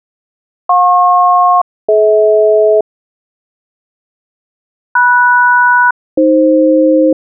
Aircraft SELCAL, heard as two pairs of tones. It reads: JP-DH MS-AF